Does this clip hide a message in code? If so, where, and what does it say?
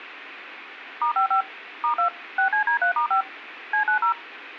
Yes: DTMF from 1.0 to 4.1 s, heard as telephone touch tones, dialled by machine, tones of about 100 ms. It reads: *55 *2 6CD3*5 C90